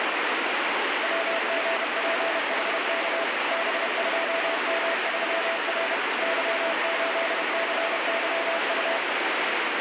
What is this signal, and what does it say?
Morse code, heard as a keyed tone, machine-sent, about 31 wpm, 660 Hz, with heavy radio static. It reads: WGPHK B2M3R Y8CYU